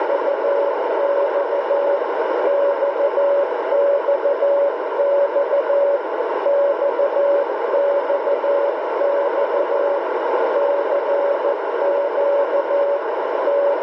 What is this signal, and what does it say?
Morse code, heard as a keyed tone, hand-sent with a paddle, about 14 wpm, 570 Hz, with heavy radio static and a narrow filter. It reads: … XXX XXX CQ …